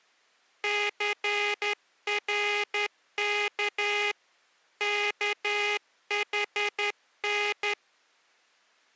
Morse code, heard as a buzzer, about 11 wpm. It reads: CRK KHN